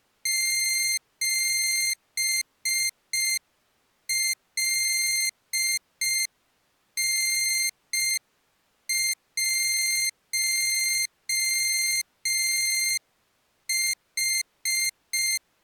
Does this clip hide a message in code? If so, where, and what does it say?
Yes: Morse code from 0.2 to 15.4 s, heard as a high beeper, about 5 wpm, 2100 Hz. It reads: 7LN1H